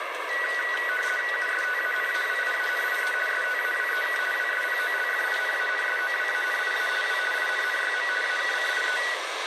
RTTY (50 baud, 450 Hz shift), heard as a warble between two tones, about 1700 Hz centre, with radio static and the noise of a subway station. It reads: USTANAWIANIE STAWEK WSPOLFINANSOWANIA W INNYM AKCIE